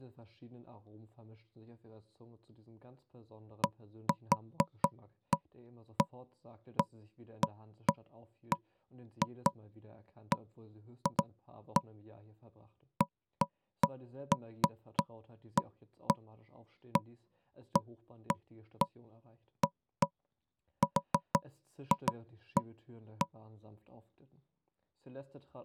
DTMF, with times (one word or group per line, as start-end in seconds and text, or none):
none